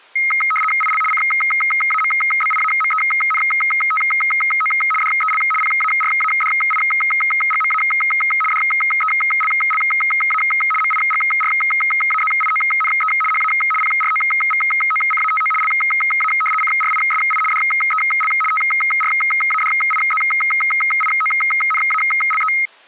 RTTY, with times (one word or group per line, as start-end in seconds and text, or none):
0.8-1.0 IL
1.1-4.7 CAMBIAMENTO
5.0-5.4 DEL
5.6-7.8 PARADIGMA
8.5-10.4 DELLA
10.8-13.1 MIGRAZIONE
13.3-13.5 HA
13.8-15.5 PROVOCATO
15.6-16.3 LA
16.6-17.4 CRISI
17.5-18.3 DEL
18.5-22.5 TRADIZIONALE